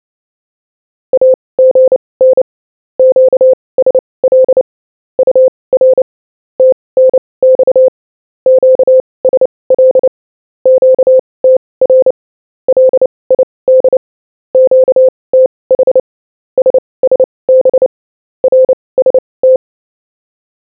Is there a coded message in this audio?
Yes: Morse code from 1.1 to 19.6 s, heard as a keyed tone, machine-sent, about 29 wpm, spaced as for 21 wpm, 520 Hz. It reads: AGN QSL UR TNX QSL QTR LID QTH SSB RST